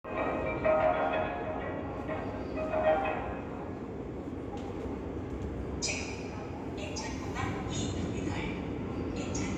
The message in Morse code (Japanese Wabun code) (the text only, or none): none